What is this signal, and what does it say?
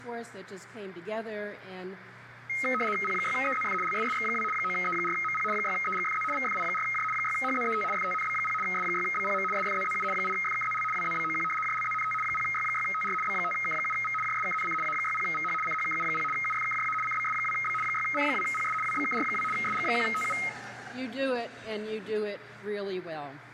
RTTY (75 baud, 850 Hz shift), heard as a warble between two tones, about 1700 Hz centre, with radio static and room echo. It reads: P6EZF LSSX2 9E4MP 6EGFZ VFI4J 6HZET FTNB0 S6BPM SFZZU 8FKZL WZBOQ JLZNT 0Y6TR B5K7V JSKNC A60VH CHKU0 UFKJA CBS2B 6C2PS WBKR2 SG1TU